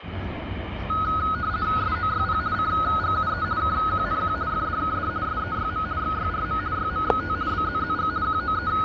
RTTY (50 baud, 170 Hz shift), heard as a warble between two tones, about 1360 Hz centre, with radio static and the noise of a park. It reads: SOYP CGUE KQNQ FDKD SEYM XYRM YMXT BZZG …